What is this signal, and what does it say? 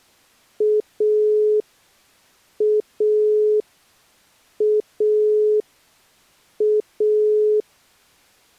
Telephone call progress tone (pulsed, as in Italy), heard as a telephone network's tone, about 420 Hz. Dial tone.